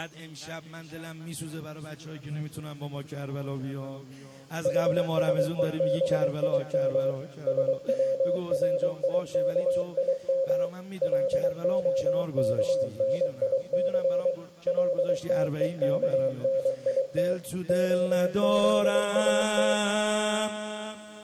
Morse code (Hebrew alphabet), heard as a keyed tone, machine-sent, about 23 wpm, 540 Hz, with room echo. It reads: חשובים שצריכים להכניס לתוכנית הזאת